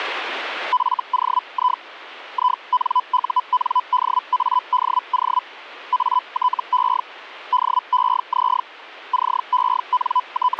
Hellschreiber (Feld-Hell, 122.5 baud), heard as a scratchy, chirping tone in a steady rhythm, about 1000 Hz. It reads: FOI INUNDADO ATE DEZ …